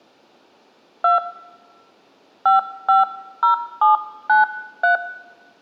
DTMF, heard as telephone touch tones, dialled by hand, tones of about 120 ms, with room echo. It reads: 2 550793